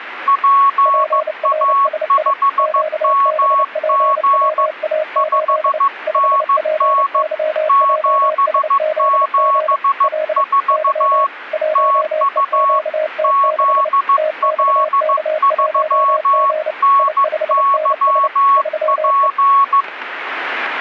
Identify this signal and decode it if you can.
Morse code, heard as two keyed tones. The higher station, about 15 wpm, 1110 Hz: PA5MG 5NN 774 TU ZL3NYP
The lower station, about 29 wpm, 620 Hz: PRSI QBPWA8 5PYJSZG L Y 1EQT6 TXK1G I5NS 3E